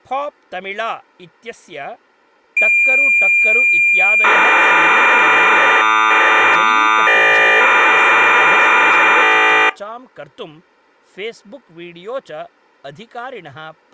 Cassette data (Kansas City type), 1200 baud, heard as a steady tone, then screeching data, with speech in Sanskrit.